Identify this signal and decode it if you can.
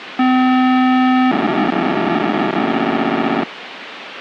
POCSAG pager data (512 baud), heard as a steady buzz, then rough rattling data, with radio hiss.